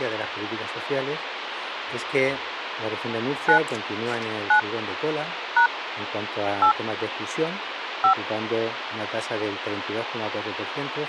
DTMF, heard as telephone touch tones, dialled by hand, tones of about 100 ms, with phone line noise. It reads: 9 9 # 8 5